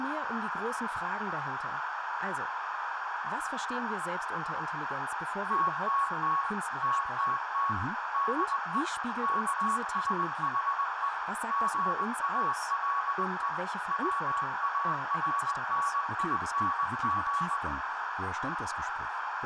Morse code, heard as a keyed tone, machine-sent, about 20 wpm, 1120 Hz, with radio static, a narrow filter and room echo. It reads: TTT TTT DE KSHE GALE WARNING